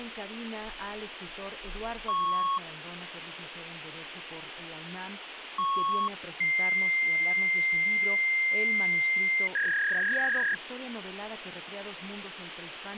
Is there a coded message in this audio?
Yes: fax machine handshake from 2.1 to 10.5 s, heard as beeps, a long tone and a warble, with phone line noise and speech in Spanish.